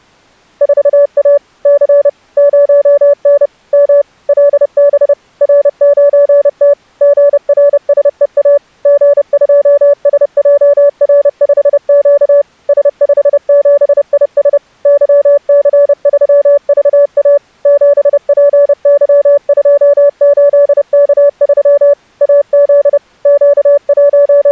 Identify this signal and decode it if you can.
Morse code, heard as a keyed tone, machine-sent, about 30 wpm, 570 Hz. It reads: 4A C 0N M LB R9T GRSEA G2SJR5Q S57IS YC3VA 7PY28K3 AZ …